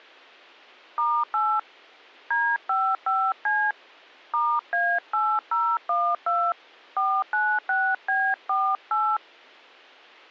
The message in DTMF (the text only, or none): *8 D55C *A8012 496B48